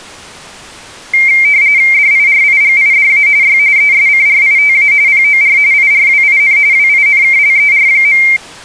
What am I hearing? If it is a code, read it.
RTTY (45.45 baud, 170 Hz shift), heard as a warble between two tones, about 2200 Hz centre. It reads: DIRIGIDA Y ESCRITA POR IRWIN WINKLER.